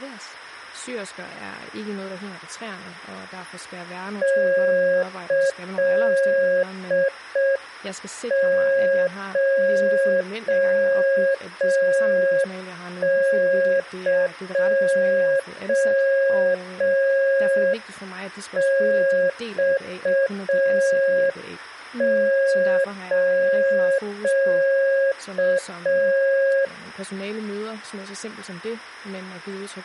Morse code (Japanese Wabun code), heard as a keyed tone, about 5 wpm, 540 Hz, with speech in Danish. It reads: キコエマス